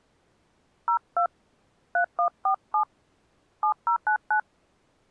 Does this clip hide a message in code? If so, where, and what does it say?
Yes: DTMF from 0.9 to 4.4 s, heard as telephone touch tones, dialled by hand, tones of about 90 ms. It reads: 02 3147 7099